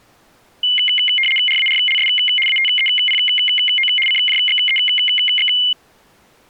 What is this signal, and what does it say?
RTTY (75 baud, 850 Hz shift), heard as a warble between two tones, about 2550 Hz centre. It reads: RARLS ATEPO CJXEX